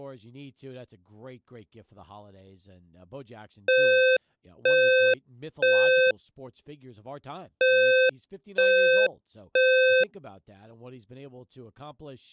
Alarm pattern, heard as an alarm's beeps, played twice, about 520 Hz, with speech in English. Temporal three. Smoke or fire, evacuate.